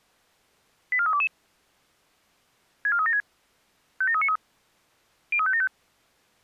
Five-tone selective call (ZVEI), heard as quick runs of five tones, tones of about 70 ms. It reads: 84322 64376 57393 03575